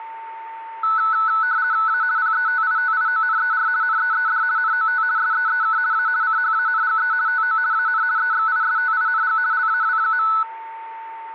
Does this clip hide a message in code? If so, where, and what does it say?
Yes: RTTY (50 baud, 170 Hz shift) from 0.8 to 10.4 s, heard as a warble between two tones, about 1400 Hz centre, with a steady whistle near 900 Hz. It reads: A PETITIONER NEED NOT SEEK A CHANGE TO AN EXISTING LAW.